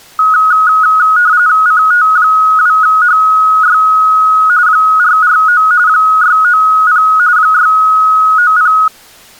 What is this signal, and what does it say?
RTTY (45.45 baud, 170 Hz shift), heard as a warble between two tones, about 1360 Hz centre. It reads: CT2HY 449 690 690